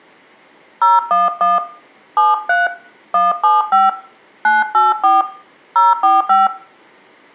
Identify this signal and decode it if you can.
DTMF, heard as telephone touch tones, dialled by hand, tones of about 180 ms, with room echo. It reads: 011 73 175 984 045